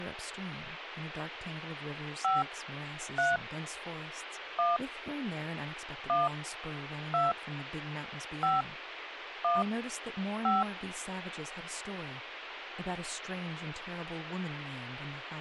DTMF, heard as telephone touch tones, dialled by hand, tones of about 180 ms, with radio hiss and speech in English. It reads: 5 3 1 1 2 5 1 5